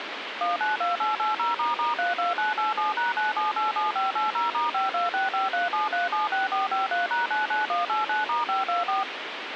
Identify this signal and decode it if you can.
DTMF, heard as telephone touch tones, dialled by machine, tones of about 150 ms, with radio hiss. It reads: 192880**32987#9787580*526537376453#99189*524